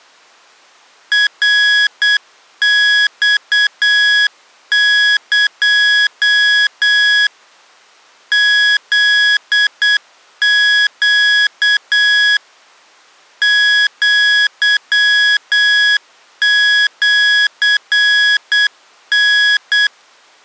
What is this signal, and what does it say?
Morse code (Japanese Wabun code), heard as electronic beeps, machine-sent, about 8 wpm, 1650 Hz. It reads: ナマエ フネ アシタ